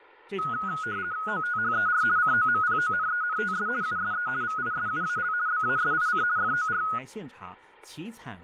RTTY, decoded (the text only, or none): OTHER COMPONENTS USE VISUAL BASIC FOR